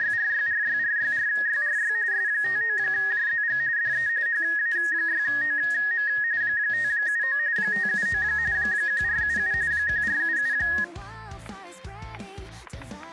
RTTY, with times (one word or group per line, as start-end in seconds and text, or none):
0.0-1.9 …
2.1-3.6 S59JZG
3.8-4.1 DE
4.3-6.1 HA6OM
6.4-7.4 579
7.6-8.2 579
8.5-9.5 1477
9.7-10.5 1477